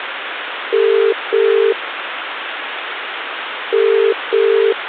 Telephone call progress tone (as in the UK, Ireland, Australia and similar networks), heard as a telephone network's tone, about 400, 450 Hz, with phone line noise. Ringback tone.